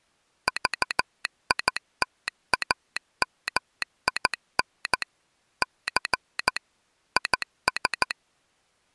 Morse code, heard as a telegraph sounder, machine-sent, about 14 wpm. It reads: VITAMIN C IS